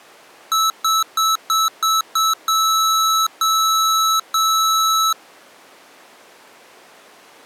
Beep code, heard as beeps from a small speaker, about 1310 Hz. 6 short, 3 long.